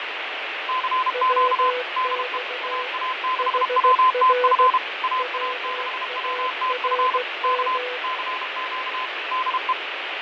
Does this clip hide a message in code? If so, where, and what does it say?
Yes: Morse code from 0.6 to 9.8 s, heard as two keyed tones, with heavy radio static and fading. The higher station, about 32 wpm, 1030 Hz: CQ DE AA6WTF AA6WTF K CQ DE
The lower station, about 16 wpm, 500 Hz: WX HR WARM